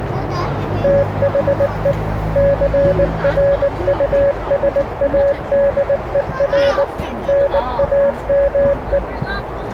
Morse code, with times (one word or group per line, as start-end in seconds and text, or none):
0.8-1.9 THE
2.4-6.8 CRUSADER
7.3-9.0 NAME